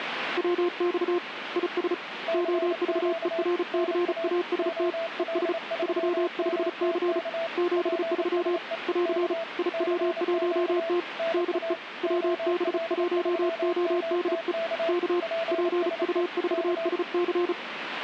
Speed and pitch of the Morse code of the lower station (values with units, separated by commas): 35 wpm, 350 Hz